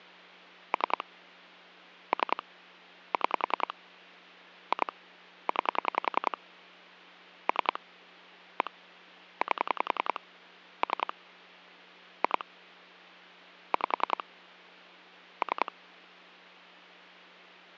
Pulse dialling, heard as clicks on a phone line, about 10 pulses a second, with hum. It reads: 3 3 6 2 9 3 1 8 3 2 5 3